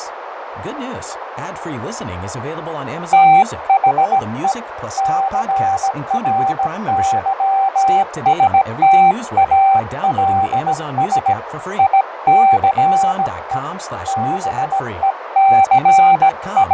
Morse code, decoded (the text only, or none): THE CRYSTALS ICE …